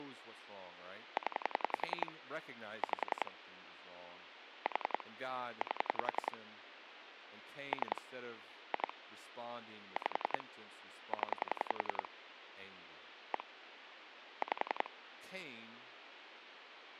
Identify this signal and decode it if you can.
Pulse dialling, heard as clicks on a phone line, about 10 pulses a second, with phone line noise and speech in English. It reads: 0 5 4 8 3 2 5 0 1 5